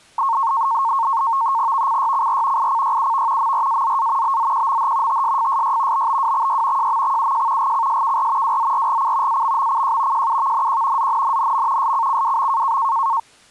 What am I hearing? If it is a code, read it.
NAVTEX (SITOR-B), 100 baud, 170 Hz shift, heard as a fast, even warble, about 1000 Hz centre. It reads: VCYCR ICYUV MRAZA BZQMH TSFSY BBWXY JMXUJ GCSKR WZRGC AMMCJ JUVNQ ZNNNM SCCWM